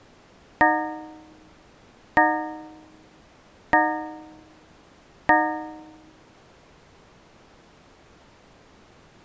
Clock strike, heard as a bell. 4. Four o'clock.